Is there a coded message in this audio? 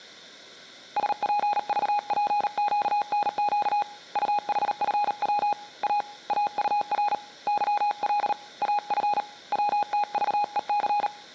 Yes: Morse code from 0.9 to 11.1 s, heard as a keyed tone, hand-sent with a paddle, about 38 wpm, 830 Hz. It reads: SPVPQNQ UHFW A AUR YL AF WTVEC